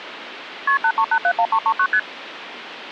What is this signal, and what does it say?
Multi-frequency trunk signalling (R1, as on North American trunks), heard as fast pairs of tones, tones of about 70 ms, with phone line noise. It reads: KP 83871339 ST